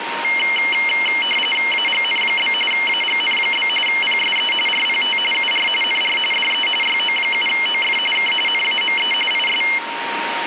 RTTY (45.45 baud, 850 Hz shift), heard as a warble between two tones, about 2550 Hz centre, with radio static and a steady whistle near 930 Hz. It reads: AGN? AGN? PSE RPT UR NR DE YO7OF K NAME IS